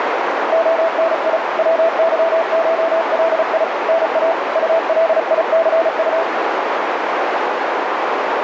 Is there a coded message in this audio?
Yes: Morse code (Russian alphabet) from 0.5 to 6.3 s, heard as a keyed tone, hand-sent with a paddle, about 35 wpm, 660 Hz, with heavy radio static and a narrow filter. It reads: ОНИ ВЫШЛИ НА УЛИЦУ